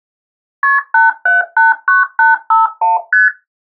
Multi-frequency trunk signalling (R1, as on North American trunks), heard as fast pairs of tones, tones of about 160 ms. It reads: KP 8789851 ST